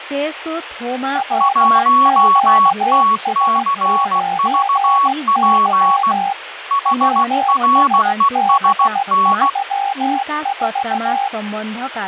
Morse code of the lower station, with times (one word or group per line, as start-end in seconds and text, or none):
1.2-6.3 LQS9Y
6.9-11.3 WSB34